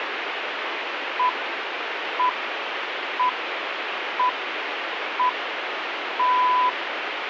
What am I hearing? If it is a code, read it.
Radio time signal (six pips, as the Greenwich Time Signal), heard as pips, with radio static.